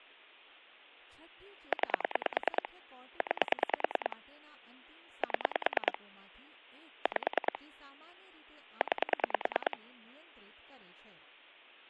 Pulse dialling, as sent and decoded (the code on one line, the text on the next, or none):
9 / 9 / 7 / 5 / 9
9 9 7 5 9